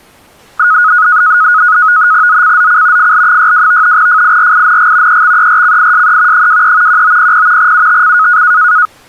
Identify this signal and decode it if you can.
NAVTEX (SITOR-B), 100 baud, 170 Hz shift, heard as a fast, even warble, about 1360 Hz centre. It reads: ZCZC FL62 FIRING EXERCISE 23 1900 UTC